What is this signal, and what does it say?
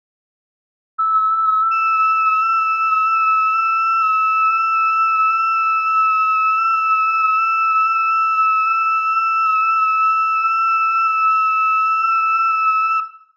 FT8 (several signals at once), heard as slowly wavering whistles, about 6.25 baud, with room echo.